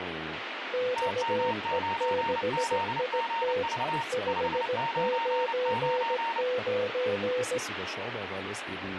Morse code, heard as two keyed tones, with radio static and speech in German. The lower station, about 17 wpm, 500 Hz: XE6IT 599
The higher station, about 29 wpm, 920 Hz: TM9ZGV 599